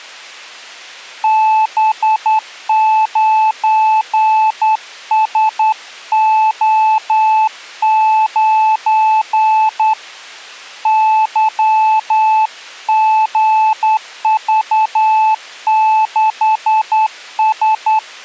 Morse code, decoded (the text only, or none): B9SO9 YGV6S